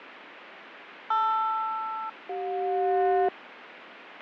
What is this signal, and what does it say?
Aircraft SELCAL, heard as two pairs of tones, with radio static and fading. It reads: LR-CJ